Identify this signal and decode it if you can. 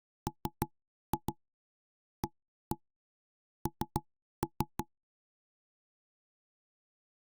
Tap code, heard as knocks on wood, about 6 knocks a second. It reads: MAN